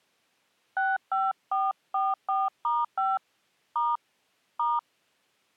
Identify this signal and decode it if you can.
DTMF, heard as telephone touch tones, dialled by hand, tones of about 200 ms. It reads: 65444*5 * *